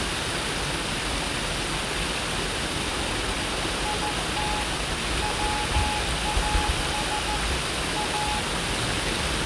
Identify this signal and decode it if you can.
Morse code, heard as a keyed tone, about 14 wpm, 840 Hz, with room echo and the noise of a park. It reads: IT WAS A